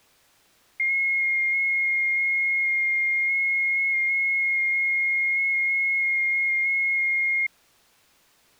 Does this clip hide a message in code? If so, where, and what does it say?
Yes: FT8 (one signal) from 0.8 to 7.5 s, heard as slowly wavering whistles, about 6.25 baud.